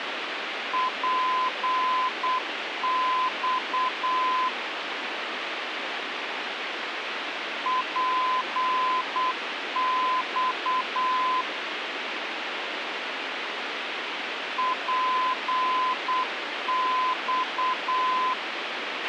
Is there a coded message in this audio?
Yes: Morse code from 0.7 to 18.4 s, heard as a keyed tone, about 8 wpm, 1020 Hz, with radio hiss and a squelch burst at the end. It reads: PX PX PX